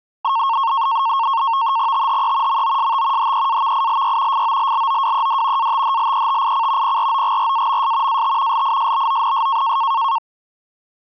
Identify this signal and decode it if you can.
NAVTEX (SITOR-B), 100 baud, 170 Hz shift, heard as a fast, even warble, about 1000 Hz centre. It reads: THE MOST HEAVILY FOLLOWED ATHLETIC PROGRAMS AT LISBONS